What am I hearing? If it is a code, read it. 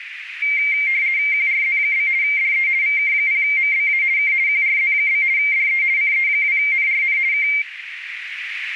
RTTY (50 baud, 170 Hz shift), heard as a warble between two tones, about 2200 Hz centre, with radio static and a narrow filter. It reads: QRZ? DE VK0MBA K QRZ? DE CE2NRN K